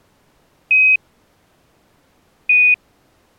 Quindar tones, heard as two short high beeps.